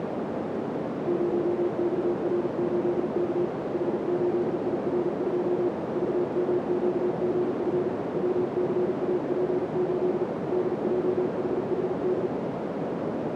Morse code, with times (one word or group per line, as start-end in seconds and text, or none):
1.1-3.5 0XR8K
3.7-5.7 H8IR2
6.0-7.9 VMQGF
8.2-10.2 WCAP8
10.5-12.3 DJHHD